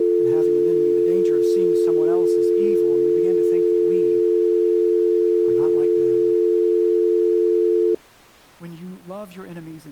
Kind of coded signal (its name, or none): telephone call progress tone